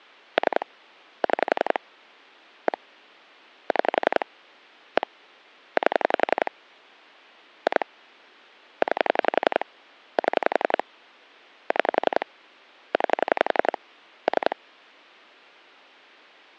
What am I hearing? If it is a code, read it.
Pulse dialling, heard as clicks on a phone line, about 11 pulses a second. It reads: 3 6 1 6 1 8 2 9 7 6 9 3